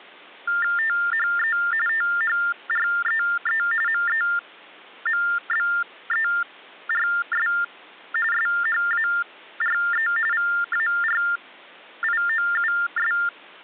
TTY/TDD text telephone tones (45.45 baud Baudot), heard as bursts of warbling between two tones, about 400 Hz shift, 1600 Hz centre. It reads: THE THREE MEMBERS SHARE VARIOUS